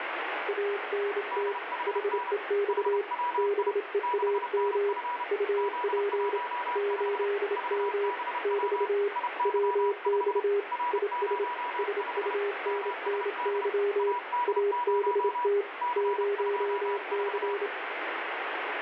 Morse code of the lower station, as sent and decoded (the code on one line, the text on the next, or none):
.- -. - / .... . -..- / -... . .- -- / ..- .--. / ---.. -- / -...- / .-- -..- / .. ... / ... ..- -. -. -.-- / .- -... - / ----- -.-.
ANT HEX BEAM UP 8M <BT> WX IS SUNNY ABT 0C